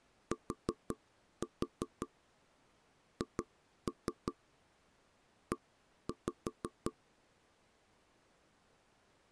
Tap code, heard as knocks on wood, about 5 knocks a second. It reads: THE